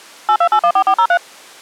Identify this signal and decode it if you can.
DTMF, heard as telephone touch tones, dialled by machine, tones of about 70 ms. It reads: 82814403